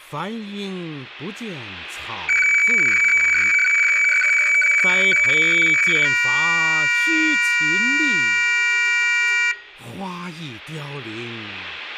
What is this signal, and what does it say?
Weather fax (radiofax), 120 lines a minute, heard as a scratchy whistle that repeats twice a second, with room echo.